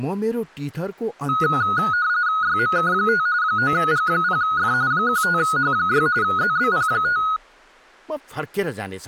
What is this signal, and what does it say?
RTTY (45.45 baud, 170 Hz shift), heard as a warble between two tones, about 1360 Hz centre, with speech in Nepali. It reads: YMK5 9G0F 15H6 ZBP5